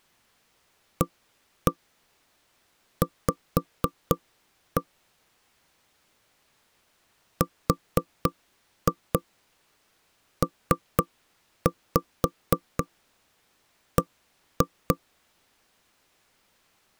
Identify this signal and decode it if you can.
Tap code, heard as knocks on wood, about 4 knocks a second. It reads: AV RPB